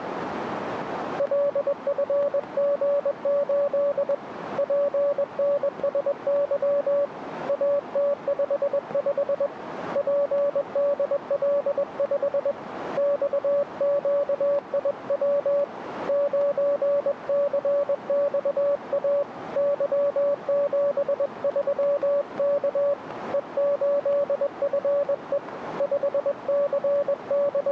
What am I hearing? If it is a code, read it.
Morse code, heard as a keyed tone, hand-sent with a paddle, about 21 wpm, 570 Hz, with radio static. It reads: LFG8 PNSY AT55 PDL5 XQIW 9CXA Y73K E8FE …